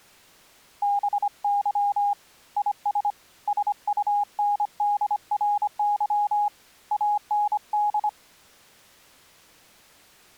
Morse code, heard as a keyed tone, hand-sent with a paddle, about 25 wpm, 820 Hz. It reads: BY IS SUNDRY AND